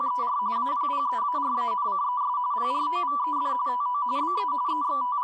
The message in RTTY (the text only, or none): … APPEARANCES PROVED TO BE …